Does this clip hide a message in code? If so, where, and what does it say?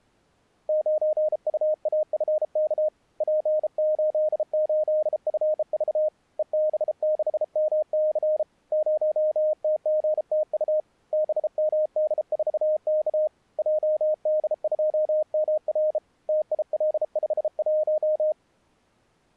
Yes: Morse code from 0.6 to 18.4 s, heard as a keyed tone, hand-sent with a bug key, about 33 wpm, 620 Hz. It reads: 9UAFK P88FV EB6MC 0TGTU BMD4K JD2MR TIL51